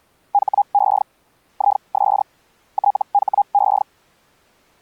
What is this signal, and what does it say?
Hellschreiber (Feld-Hell, 122.5 baud), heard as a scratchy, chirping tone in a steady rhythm, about 810 Hz. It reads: HE IS THE